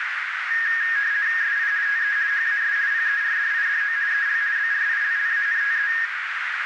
RTTY (50 baud, 170 Hz shift), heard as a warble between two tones, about 1750 Hz centre, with radio static and a narrow filter. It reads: SI TE HAS PERDIDO EL BRILLANTE